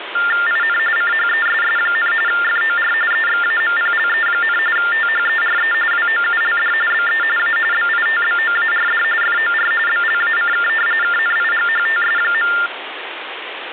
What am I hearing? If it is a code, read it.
TTY/TDD text telephone tones (45.45 baud Baudot), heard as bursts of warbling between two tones, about 400 Hz shift, 1600 Hz centre, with phone line noise. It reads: IN CHESS, FOR EXAMPLE, THERE WOULD BE A BITBOARD FOR BLACK KNIGHTS.